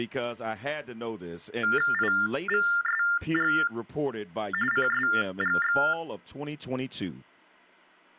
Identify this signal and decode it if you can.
TTY/TDD text telephone tones (45.45 baud Baudot), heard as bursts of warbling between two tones, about 400 Hz shift, 1600 Hz centre, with speech in English. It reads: IVSG CSGX